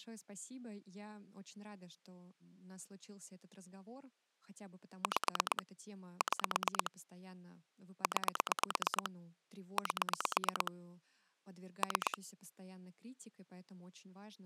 Pulse dialling, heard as clicks on a phone line, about 8 pulses a second, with speech in Russian. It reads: 5 6 9 8 3